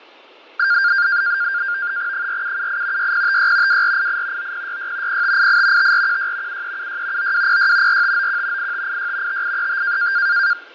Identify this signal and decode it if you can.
NAVTEX (SITOR-B), 100 baud, 170 Hz shift, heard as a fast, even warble, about 1500 Hz centre, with fading. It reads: 4778 6056 2488 9066 0588 5416 7376 9206 4591 8586 5835